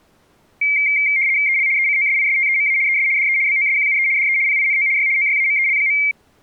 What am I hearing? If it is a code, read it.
RTTY (75 baud, 170 Hz shift), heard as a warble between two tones, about 2200 Hz centre. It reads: EL ECOSISTEMA ES DE BOSQUE DE PINO Y OYAMEL.